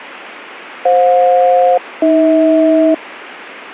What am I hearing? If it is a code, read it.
Aircraft SELCAL, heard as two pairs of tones. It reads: FJ-AH